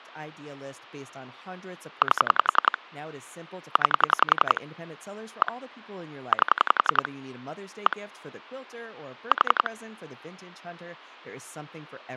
Pulse dialling, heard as clicks on a phone line, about 11 pulses a second, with phone line noise and speech in English. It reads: 8 9 1 8 1 4